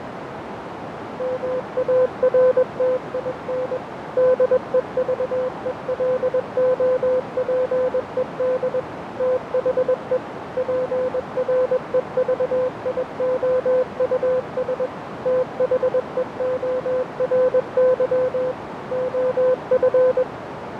Morse code, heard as a keyed tone, machine-sent, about 21 wpm, 510 Hz, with radio static, fading and a narrow filter. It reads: MARTIN DEVELOPED THE PREVIOUS THEORY OF